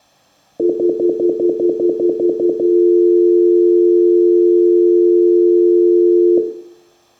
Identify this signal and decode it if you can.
Telephone call progress tone (North American plan), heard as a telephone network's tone, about 350, 440 Hz, 0.1 s on and 0.1 s off, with room echo. Stutter dial tone.